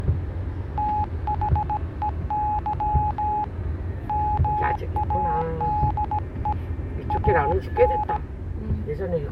Morse code, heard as a keyed tone, hand-sent with a bug key, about 17 wpm, 840 Hz, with the noise inside a car. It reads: THEY MADE AN